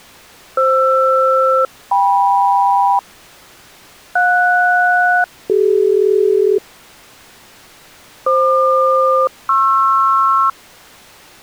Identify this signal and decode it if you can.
Aircraft SELCAL, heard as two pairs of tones. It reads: FR-KM JS-CD FQ-PR